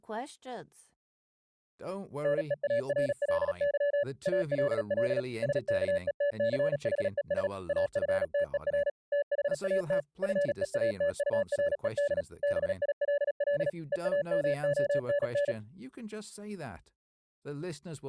Morse code, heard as a keyed tone, machine-sent, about 37 wpm, 570 Hz, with speech in English. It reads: NEARLY ALL SKETCHES AFTER THAT FEATURED BILL EAMONN